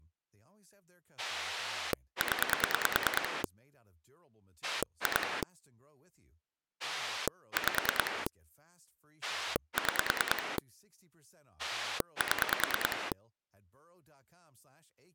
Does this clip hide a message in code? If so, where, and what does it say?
Yes: pulse dialling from 1.2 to 13.1 s, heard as a rotary dial, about 9 pulses a second, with speech in English. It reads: 0 2 5 6 7